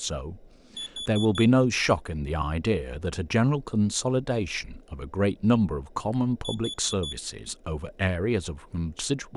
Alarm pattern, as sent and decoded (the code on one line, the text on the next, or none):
4 beeps and a pause
temporal four